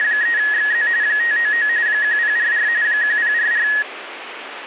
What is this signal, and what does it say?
RTTY (45.45 baud, 170 Hz shift), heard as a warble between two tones, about 1800 Hz centre, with radio static. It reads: … 599 1044 1044